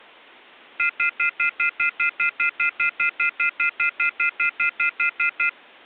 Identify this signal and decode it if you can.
Telephone call progress tone (North American plan), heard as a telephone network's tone, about 1400, 2050, 2450, 2600 Hz, 0.1 s on and 0.1 s off. Off-hook warning tone.